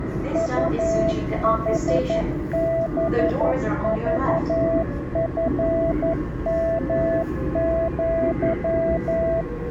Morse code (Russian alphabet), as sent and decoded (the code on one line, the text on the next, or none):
..- .... -... ...- ..-. -- --.--
УХБЖФМЪ